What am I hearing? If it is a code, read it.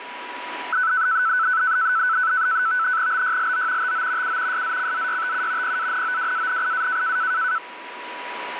NAVTEX (SITOR-B), 100 baud, 170 Hz shift, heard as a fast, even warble, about 1410 Hz centre, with radio static and a steady whistle near 980 Hz. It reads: BYLO TO U SZCZYTU PANOWANIA